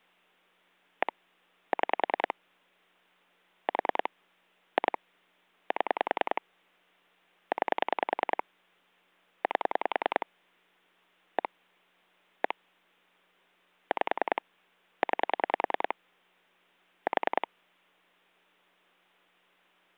Pulse dialling, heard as clicks on a phone line, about 10 pulses a second. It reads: 1 6 4 2 7 9 8 1 1 5 9 4